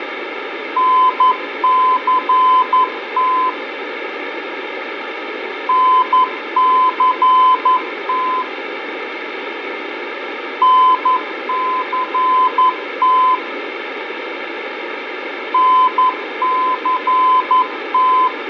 Morse code, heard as a keyed tone, machine-sent, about 11 wpm, 1020 Hz, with radio static, fading and room echo. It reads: NCT NCT NCT NCT